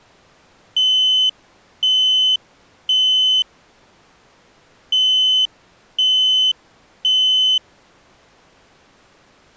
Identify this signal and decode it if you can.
Alarm pattern, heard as an alarm's beeps, played twice, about 3050 Hz. Temporal three. Smoke or fire, evacuate.